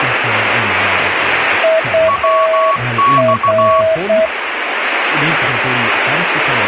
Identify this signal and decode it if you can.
Morse code, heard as two keyed tones, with radio static and speech in Swedish. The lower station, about 8 wpm, 640 Hz: UR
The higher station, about 16 wpm, 1120 Hz: WX